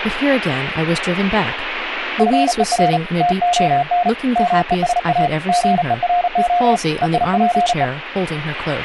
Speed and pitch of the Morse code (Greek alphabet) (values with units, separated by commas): 36 wpm, 710 Hz